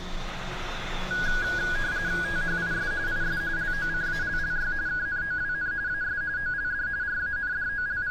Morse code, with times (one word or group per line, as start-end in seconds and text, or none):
none